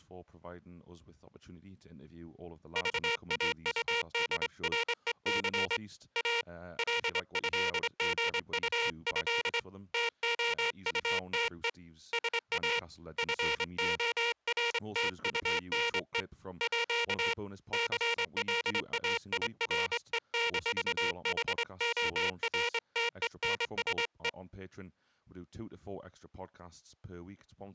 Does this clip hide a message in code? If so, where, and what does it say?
Yes: Morse code (with French letters) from 2.7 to 24.4 s, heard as a buzzer, hand-sent with a straight key, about 24 wpm, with speech in English. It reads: VAUDREC A LÉGUÉ TOUTE SA FORTUNE À CLAIRE-HORTENSE